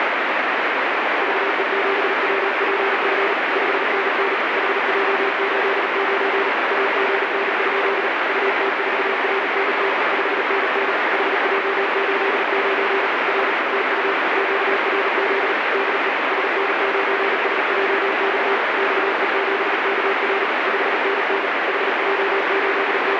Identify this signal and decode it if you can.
Morse code, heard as a keyed tone, machine-sent, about 38 wpm, 390 Hz, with heavy radio static. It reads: VE7WPF 5NN HJ89 AGN? UT4RNT 5NN HJ89 R TU QRZ DE SN9SJX XE7KR 5NN …